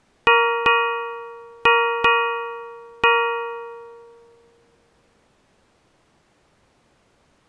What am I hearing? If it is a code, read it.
Ship's bell, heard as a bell. 5. Five half-hours of the watch have passed.